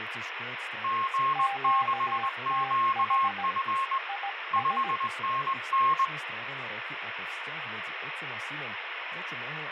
Morse code, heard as two keyed tones, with radio static and speech in Slovak. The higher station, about 21 wpm, 1080 Hz: G6QF 5NN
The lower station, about 17 wpm, 800 Hz: QTH IS